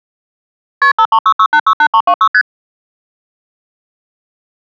Multi-frequency trunk signalling (R1, as on North American trunks), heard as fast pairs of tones, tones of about 70 ms. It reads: KP 5366868326 ST